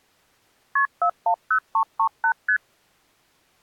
Multi-frequency trunk signalling (R1, as on North American trunks), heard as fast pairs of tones, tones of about 80 ms. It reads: KP 410338 ST